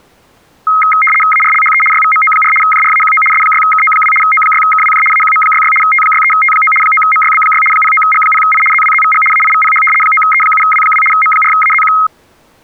RTTY (75 baud, 850 Hz shift), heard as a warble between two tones, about 1700 Hz centre. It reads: ARLHE YVMO4 JRAQO S6KO2 O6KWJ AQM66 T63T9 9MYB6 09G0I ZWZVG AIVPH 9E7W2 M4AZQ